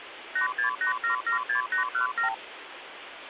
Multi-frequency trunk signalling (R2, with the far end's replies), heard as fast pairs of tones, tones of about 110 ms, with phone line noise. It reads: 868776817